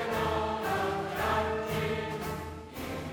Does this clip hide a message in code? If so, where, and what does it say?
No.